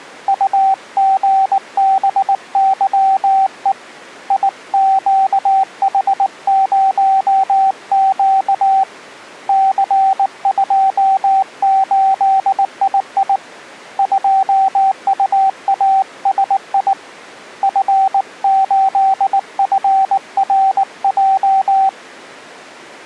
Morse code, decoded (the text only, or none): UGBYE IQH0Q C28II 2UASI F8FRJ